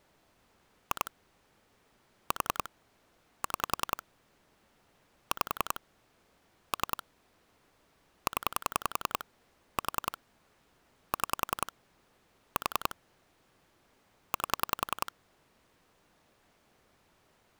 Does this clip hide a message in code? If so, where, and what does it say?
Yes: pulse dialling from 0.9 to 15.1 s, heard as clicks on a phone line, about 10 pulses a second. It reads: 2 4 6 5 3 0 4 6 4 8